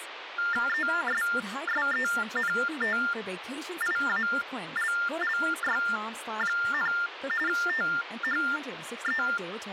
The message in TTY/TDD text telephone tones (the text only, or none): ESSENTIALLY, THE